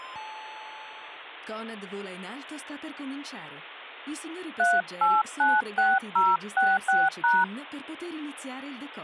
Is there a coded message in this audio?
Yes: DTMF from 4.6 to 7.4 s, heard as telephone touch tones, dialled by hand, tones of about 210 ms. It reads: 3896066#